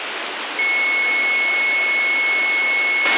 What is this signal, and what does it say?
A steady tone, with radio hiss and a squelch burst at the end. There is no code.